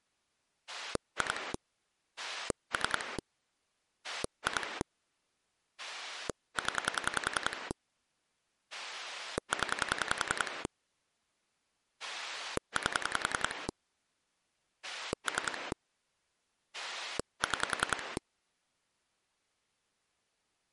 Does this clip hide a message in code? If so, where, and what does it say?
Yes: pulse dialling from 0.7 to 18.2 s, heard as a rotary dial, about 10 pulses a second. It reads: 2 3 2 0 0 8 3 6